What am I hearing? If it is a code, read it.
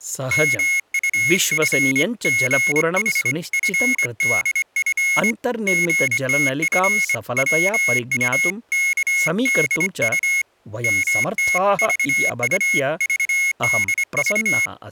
Morse code (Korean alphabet), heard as a high beeper, hand-sent with a straight key, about 24 wpm, 2150 Hz, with speech in Sanskrit. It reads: 민수는 선비의 머리를